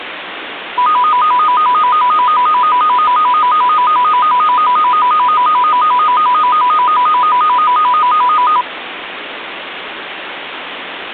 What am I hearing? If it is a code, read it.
A tone that alternates evenly between two pitches, with phone line noise. There is no code.